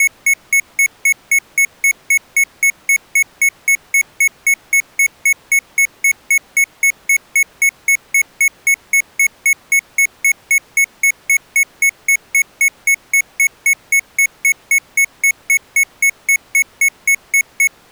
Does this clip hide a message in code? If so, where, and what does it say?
No, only evenly repeated beeps.